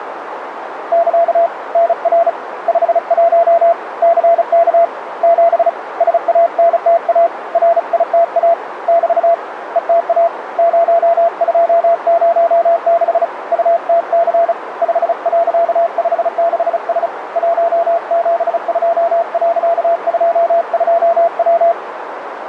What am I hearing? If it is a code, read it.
Morse code, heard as a keyed tone, hand-sent with a paddle, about 35 wpm, 680 Hz, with radio static and a narrow filter. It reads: <KA> NR 51 CK 7 SANTA RITA <BT> ETA 0206 UTC 5.56S 172.22W